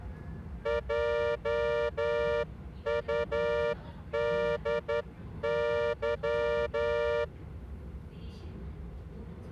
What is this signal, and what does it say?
Morse code, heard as a horn, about 10 wpm, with the noise inside a subway train. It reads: JUDY